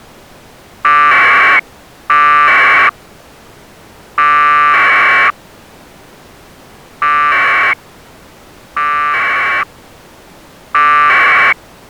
Packet radio (AX.25, as in APRS), 1200 baud, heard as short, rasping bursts.